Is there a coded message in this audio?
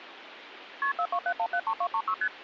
Yes: multi-frequency trunk signalling (R1, as on North American trunks) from 0.8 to 2.3 s, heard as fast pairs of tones, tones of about 70 ms, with phone line noise. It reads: KP 427173236 ST